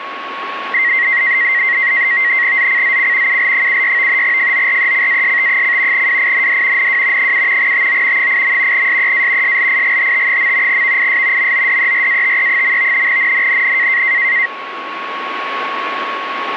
NAVTEX (SITOR-B), 100 baud, 170 Hz shift, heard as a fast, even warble, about 2000 Hz centre, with radio static and a steady whistle near 1100 Hz. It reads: ZCZC UL76 FORECAST: WIND NW 7 TO 8. SEA SLIGHT. VIS MODERATE. NNNN